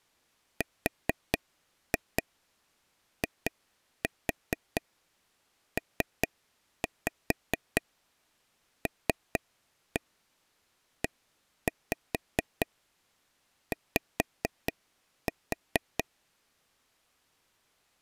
Tap code, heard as taps on a table, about 4 knocks a second. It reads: RIPLEY